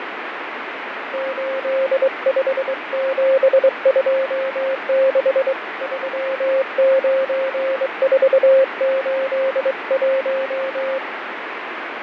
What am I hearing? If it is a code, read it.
Morse code, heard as a keyed tone, hand-sent with a straight key, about 23 wpm, 530 Hz, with radio static and fading. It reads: 85726 39481